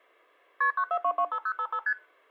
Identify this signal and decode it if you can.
Multi-frequency trunk signalling (R1, as on North American trunks), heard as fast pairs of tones, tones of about 70 ms. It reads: KP 94225055 ST